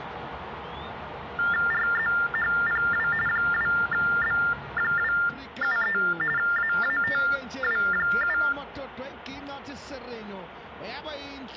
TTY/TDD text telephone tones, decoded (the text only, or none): RZHPW 2B273 AATW7